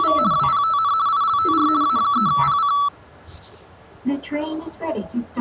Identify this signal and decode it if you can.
RTTY (50 baud, 170 Hz shift), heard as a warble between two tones, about 1230 Hz centre, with the noise inside a subway train. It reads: … WPTN ILTR A3PC